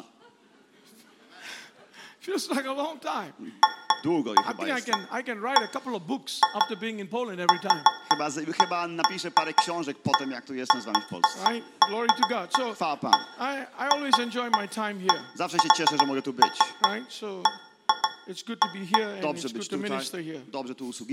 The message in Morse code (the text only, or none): none